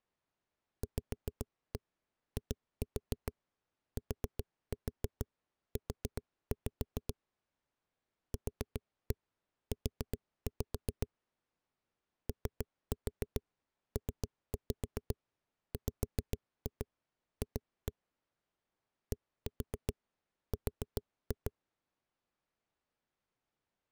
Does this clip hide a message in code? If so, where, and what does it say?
Yes: tap code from 0.8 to 21.5 s, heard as knocks on a wall, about 7 knocks a second. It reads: VITU QU OPWF DR